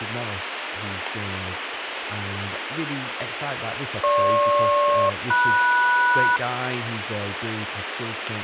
Aircraft SELCAL, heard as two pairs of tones, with radio static and speech in English. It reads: GP-MS